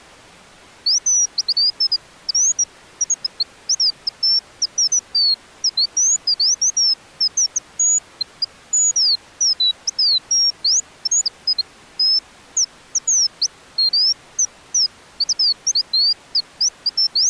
Bird-like chirps. There is no code.